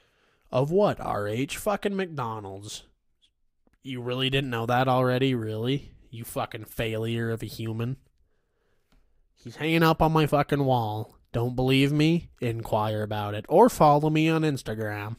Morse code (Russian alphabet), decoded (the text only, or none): none